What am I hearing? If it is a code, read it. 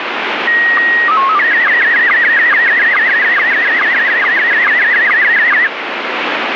SSTV (slow-scan television), Scottie S1, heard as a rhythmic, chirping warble, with heavy radio static.